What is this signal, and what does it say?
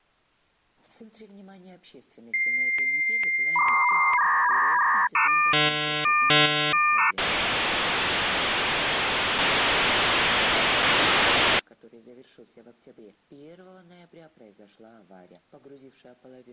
Dial-up modem handshake (V.34 or later), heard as a whistle, warbles, then hiss.